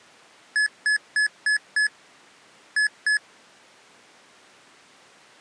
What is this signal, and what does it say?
Beep code, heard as beeps from a small speaker, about 1700 Hz. 5-2.